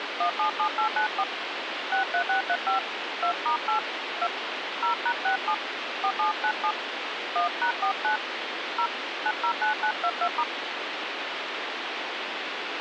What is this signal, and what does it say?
DTMF, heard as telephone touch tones, dialled by hand, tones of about 90 ms, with phone line noise. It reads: 177894 63635 2*8 2 0#67 4797 1#49 0 909922*